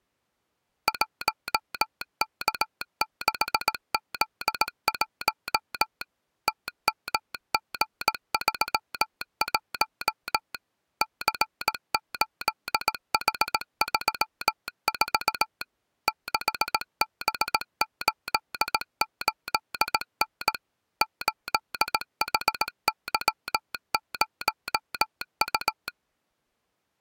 Morse code, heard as a telegraph sounder, machine-sent, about 18 wpm. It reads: 1K6Z1 TMG31 C8H34 6B88N 8HY0U